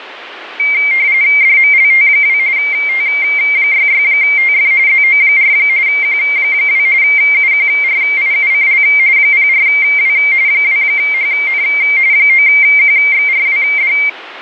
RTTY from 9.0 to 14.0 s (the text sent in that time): 04W 2HN 9QXRWD